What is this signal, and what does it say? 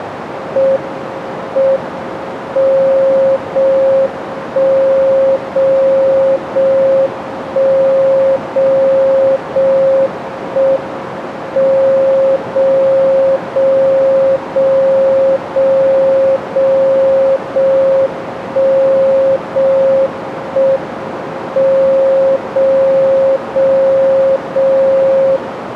Radio time signal (JJY), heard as a tone whose level steps once a second, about 540 Hz, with radio static and a narrow filter. The time is 05:29 Japan time. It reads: M M 0 1 0 0 1 0 0 1 M 0 0 0 0 0 0 1 0 1 M 0 0 0 0